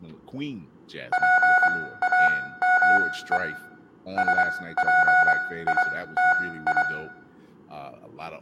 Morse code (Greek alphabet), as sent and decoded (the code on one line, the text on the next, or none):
.--. .- -- . / ... .--. .. - ..
ΠΑΜΕ ΣΠΙΤΙ